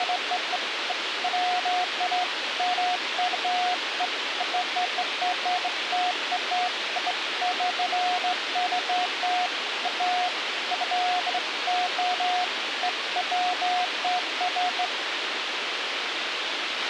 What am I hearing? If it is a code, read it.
Beeps of irregular length, with radio hiss and a squelch burst at the end. There is no code.